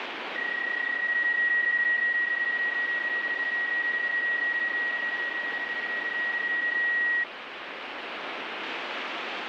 PSK31 (31.25 baud), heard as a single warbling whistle, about 1900 Hz, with radio static.